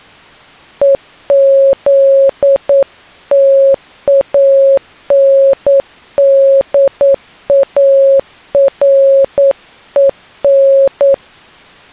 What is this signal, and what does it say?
Morse code, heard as a keyed tone, hand-sent with a paddle, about 9 wpm, 550 Hz. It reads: EZTANDAREN